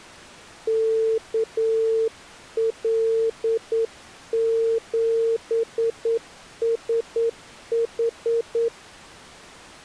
Morse code, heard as a keyed tone, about 9 wpm, 450 Hz. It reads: KL7SH